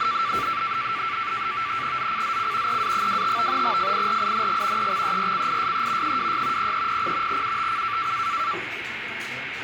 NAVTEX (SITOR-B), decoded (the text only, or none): ZCZC EA25 FIRING EXERCISE 26 0300 UTC